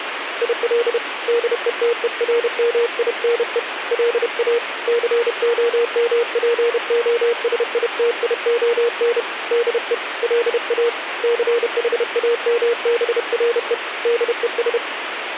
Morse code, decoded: IL DETERMINE LA COMPOSITION DE LA CHAMBRE DES

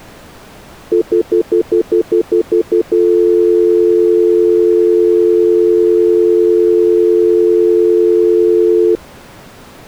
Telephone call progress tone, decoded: stutter dial tone

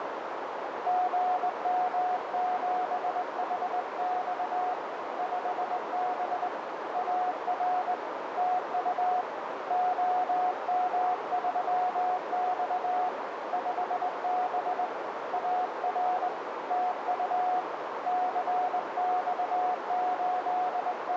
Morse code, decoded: GM7HX 5B AR TU OM3X 5B AR TU …

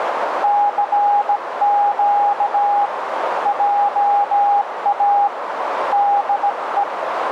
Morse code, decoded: CQ JA DE

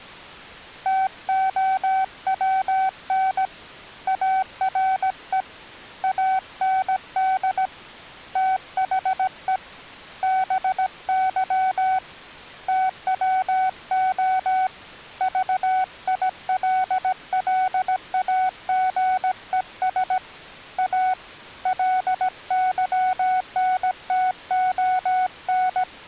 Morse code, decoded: TOWN ARE AND THE BY TWO VILLAGES A LYNTON

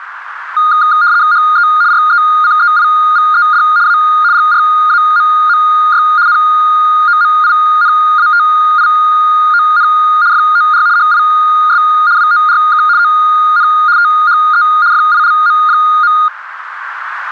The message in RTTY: HE RECEIVED A GRAMMY NOMINATION FOR HIS WORK ON THE FILM.

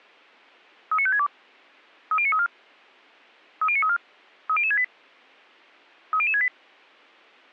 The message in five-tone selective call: 39562 30934 30934 30068 30068

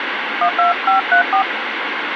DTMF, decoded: 12534

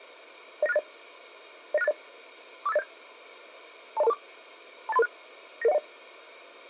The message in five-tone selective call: 09680 09680 45807 20224 28336 99010

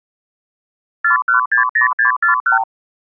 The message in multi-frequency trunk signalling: 4160641

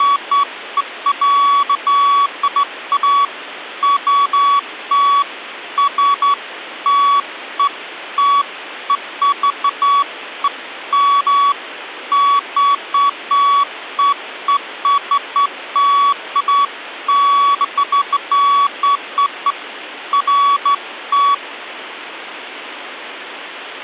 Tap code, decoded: none

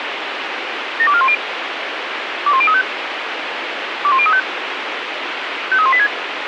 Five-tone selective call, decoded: 72410 21035 21035 53186

